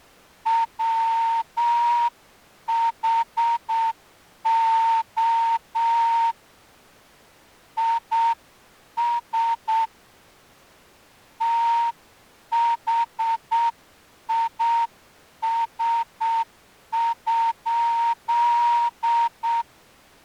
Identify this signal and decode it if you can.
Morse code, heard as a whistle, hand-sent with a straight key, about 7 wpm. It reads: WHO IS THIS?